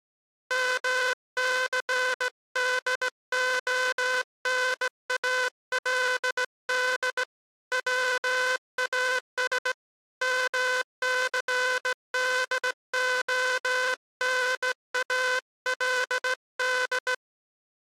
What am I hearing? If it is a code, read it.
Morse code, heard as a buzzer, hand-sent with a straight key, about 17 wpm. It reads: MCDONALD WAS MCDONALD